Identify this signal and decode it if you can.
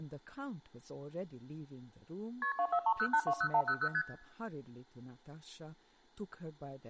Multi-frequency trunk signalling (R1, as on North American trunks), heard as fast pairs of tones, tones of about 70 ms, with speech in English. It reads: KP 2430820100 ST